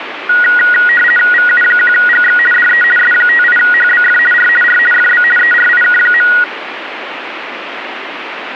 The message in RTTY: VU1GX DE S58HBF R R FB ERIK.

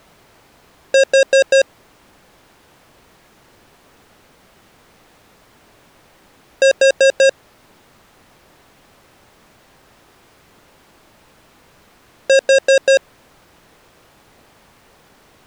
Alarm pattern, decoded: temporal four

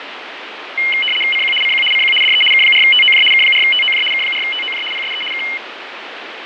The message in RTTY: CQ CQ CQ DE K4TOJ K4TOJ K4TOJ PSE K

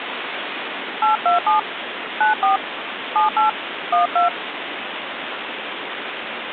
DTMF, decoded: 827 94 78 12

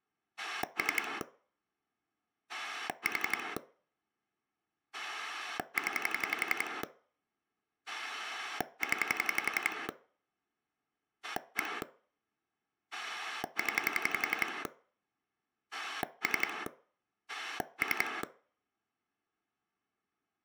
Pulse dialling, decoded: 3 4 0 0 1 0 3 3

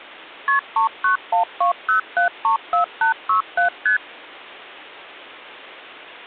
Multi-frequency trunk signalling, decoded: KP 39120734867 ST

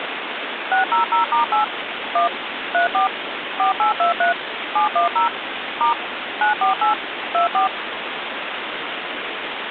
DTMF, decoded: 600*8 1 34 4823 710 * 948 24

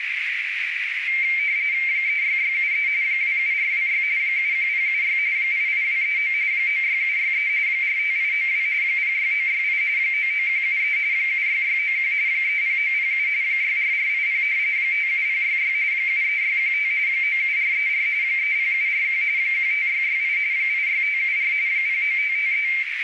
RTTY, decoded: 36673 27426 71076 88239 96763 45892 06968 99173 76691 30907 64480 57066 73615 97434 30741 15668 86574 09553

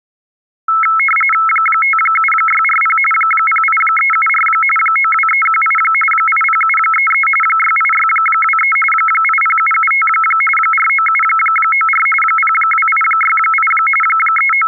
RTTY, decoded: 57640 08374 92318 80733 68623 80775 49794 02868 …

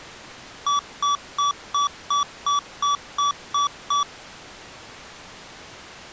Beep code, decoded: 10 short

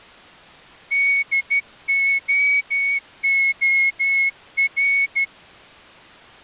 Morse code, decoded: DOOR

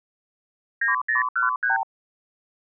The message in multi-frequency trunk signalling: 9013

